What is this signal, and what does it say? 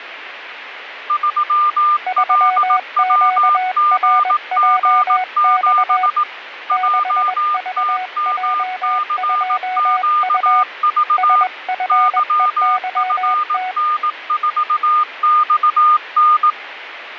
Morse code, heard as two keyed tones, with radio static. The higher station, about 18 wpm, 1210 Hz: 3LWGG7 JTMCQV YFN4XN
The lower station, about 21 wpm, 740 Hz: 3QRJX 6VJ2U SFEYT